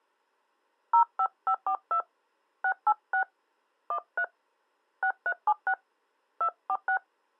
DTMF, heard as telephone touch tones, dialled by hand, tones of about 80 ms. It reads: 05542 686 13 6376 246